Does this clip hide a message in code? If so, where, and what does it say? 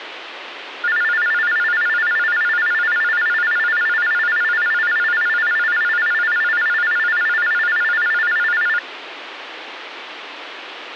No, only a tone that alternates evenly between two pitches, with phone line noise.